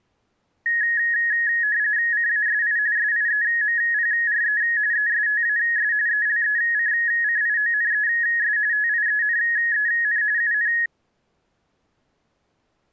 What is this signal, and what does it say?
RTTY (45.45 baud, 170 Hz shift), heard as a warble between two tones, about 1800 Hz centre. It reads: CASI SIEMPRE ESTAS ELECCIONES TIENEN UN